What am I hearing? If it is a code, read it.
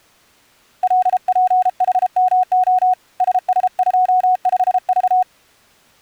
Morse code, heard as a keyed tone, hand-sent with a paddle, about 33 wpm, 740 Hz. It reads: LPHMO SS25V